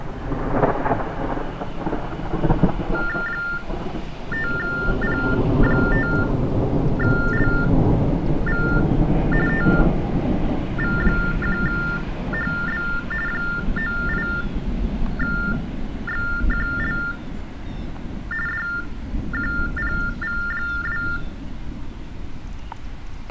TTY/TDD text telephone tones (45.45 baud Baudot), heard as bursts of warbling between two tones, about 400 Hz shift, 1600 Hz centre. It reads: 5P5LV TV1HB 98XQL DQPV2